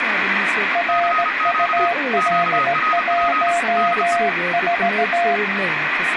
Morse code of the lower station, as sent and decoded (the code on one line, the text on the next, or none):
.-. ..- .-.. .---- ....-
RUL14